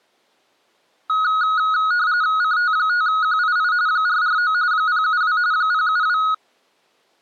RTTY (45.45 baud, 170 Hz shift), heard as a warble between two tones, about 1360 Hz centre. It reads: CT5QII 449 072 072